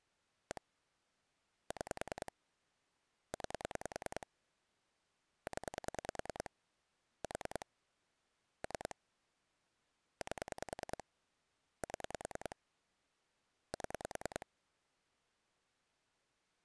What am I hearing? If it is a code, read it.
Pulse dialling, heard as clicks on a phone line, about 10 pulses a second. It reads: 1 6 9 0 4 3 8 7 7